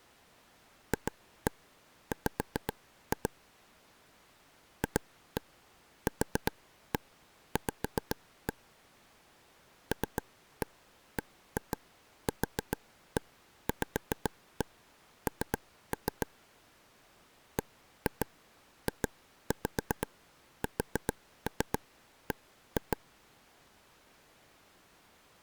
Tap code, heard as taps on a table, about 7 knocks a second. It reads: FW FQV LBQVN BJSB